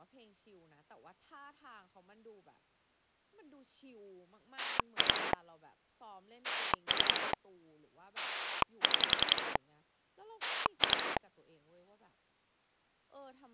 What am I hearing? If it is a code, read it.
Pulse dialling, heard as a rotary dial, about 11 pulses a second, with speech in Thai. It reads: 2 3 6 2